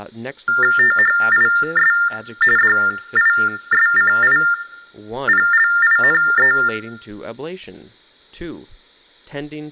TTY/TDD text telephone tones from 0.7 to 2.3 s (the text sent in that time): THIS